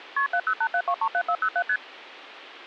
Multi-frequency trunk signalling (R1, as on North American trunks), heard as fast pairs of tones, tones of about 70 ms. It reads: KP 7087237407 ST